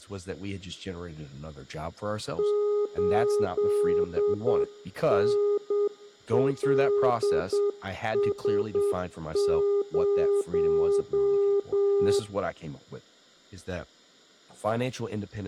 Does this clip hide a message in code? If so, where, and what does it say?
Yes: Morse code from 2.3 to 12.3 s, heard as a keyed tone, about 8 wpm, 410 Hz, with room echo and speech in English. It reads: 8NLS0